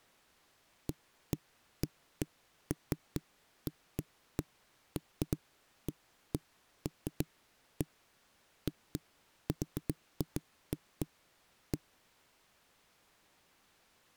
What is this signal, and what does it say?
Irregular knocks on a wall. There is no code.